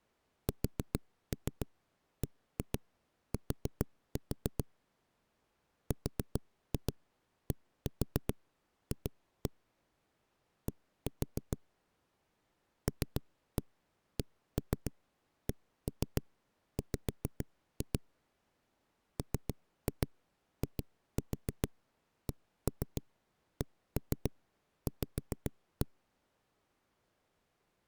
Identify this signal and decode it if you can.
Tap code, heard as knocks on a wall, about 7 knocks a second. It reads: SBT RDF D LCCW MICCV